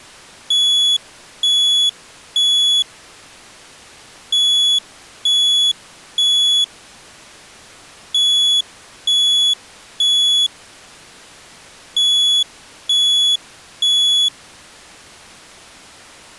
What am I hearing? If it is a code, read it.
Alarm pattern, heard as an alarm's beeps, played four times, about 3400 Hz. Temporal three. Smoke or fire, evacuate.